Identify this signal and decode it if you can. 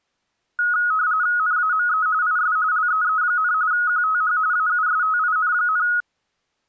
RTTY (45.45 baud, 170 Hz shift), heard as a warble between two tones, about 1360 Hz centre. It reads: NAME IS LEE, QTH AUSTIN,